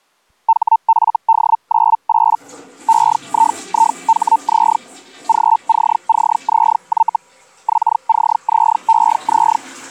Hellschreiber (Feld-Hell, 122.5 baud), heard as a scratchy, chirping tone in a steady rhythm, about 900 Hz, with the noise of a restroom. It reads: HFD98 EIIHZ GCCZY XCZEZ